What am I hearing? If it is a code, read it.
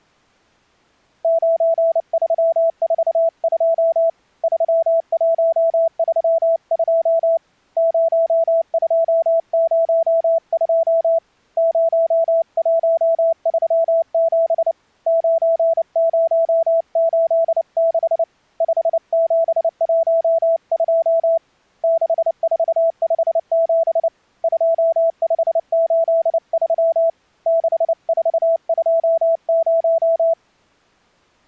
Morse code, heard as a keyed tone, hand-sent with a paddle, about 29 wpm, 660 Hz. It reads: 9342 3132 0202 0137 9086 5712 6457 2583 6420